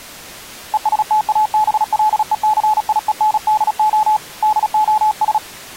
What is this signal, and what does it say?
Morse code, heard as a keyed tone, hand-sent with a paddle, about 36 wpm, 860 Hz. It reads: ESTABLECIENDO DOS